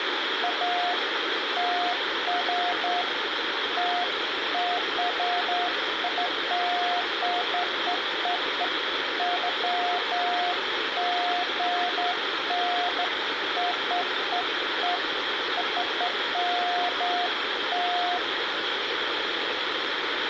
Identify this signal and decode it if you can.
Beeps of irregular length, with phone line noise and room echo. There is no code.